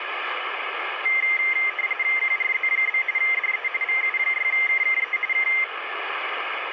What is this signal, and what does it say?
RTTY (45.45 baud, 170 Hz shift), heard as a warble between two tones, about 2000 Hz centre, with radio static. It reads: QRZ? DE VU6KKE K